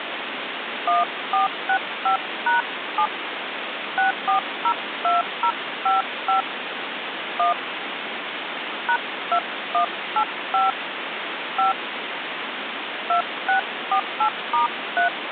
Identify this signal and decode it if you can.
DTMF, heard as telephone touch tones, dialled by hand, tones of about 120 ms, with phone line noise. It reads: 1465#7 6402055 1 #2185 5 2648*3